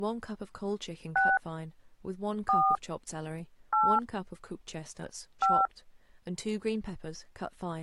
DTMF, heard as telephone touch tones, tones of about 230 ms, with speech in English. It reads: 6 4 8 5